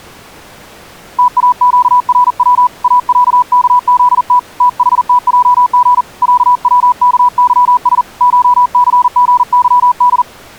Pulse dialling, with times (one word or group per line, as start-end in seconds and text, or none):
none